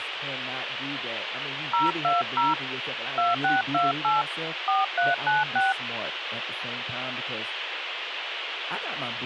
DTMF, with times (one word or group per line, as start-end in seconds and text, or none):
1.7-2.5 020
3.2-4.2 2628
4.7-5.7 4396